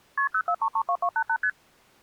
Multi-frequency trunk signalling (R1, as on North American trunks), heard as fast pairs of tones, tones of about 70 ms. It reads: KP 04332288 ST